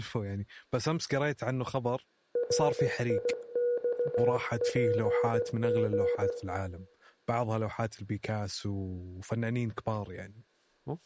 Morse code, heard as a keyed tone, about 16 wpm, 480 Hz, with room echo and speech in Arabic. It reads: RIXPG